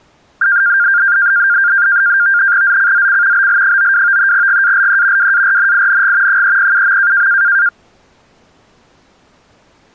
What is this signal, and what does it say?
NAVTEX (SITOR-B), 100 baud, 170 Hz shift, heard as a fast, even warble, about 1500 Hz centre. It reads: ZCZC BL92 GALE WARNING 307.